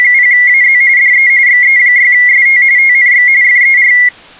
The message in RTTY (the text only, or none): … DE XE6ST TNX FER